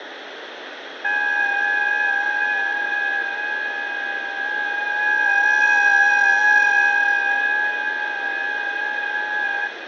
FT8 (several signals at once), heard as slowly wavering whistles, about 6.25 baud, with radio static, fading and room echo.